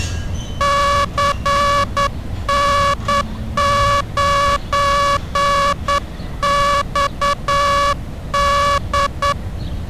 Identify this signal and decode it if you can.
Morse code, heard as a buzzer, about 9 wpm, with street noise. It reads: CN9XD